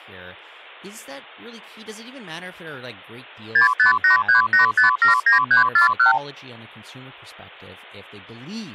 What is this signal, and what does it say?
Multi-frequency trunk signalling (R2, with the far end's replies), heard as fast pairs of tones, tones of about 120 ms, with speech in English. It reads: 65838579341